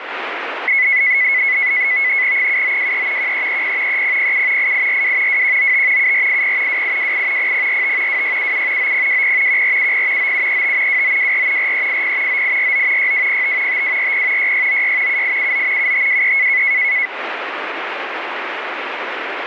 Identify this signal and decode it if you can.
NAVTEX (SITOR-B), 100 baud, 170 Hz shift, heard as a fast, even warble, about 2100 Hz centre, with radio static. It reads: 7923 1330 3007 8842 2195 7480 2828 0045 2677 9020 1470 9735 2924 4380 9849 6205 5240 6696 7879 7523